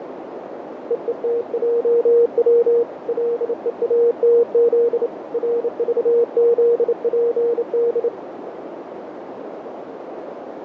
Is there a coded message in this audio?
Yes: Morse code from 0.8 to 8.1 s, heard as a keyed tone, hand-sent with a bug key, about 28 wpm, 470 Hz, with radio static and a narrow filter. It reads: EETJW LEATZ RVZPD